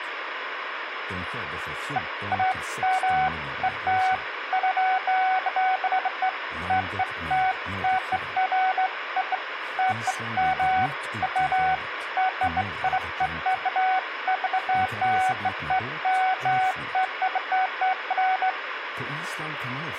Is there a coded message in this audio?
No, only beeps of irregular length, with phone line noise.